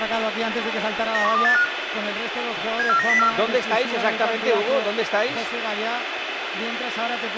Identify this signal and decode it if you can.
Five-tone selective call (CCIR), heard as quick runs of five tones, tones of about 100 ms, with radio hiss and room echo. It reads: 91285 74904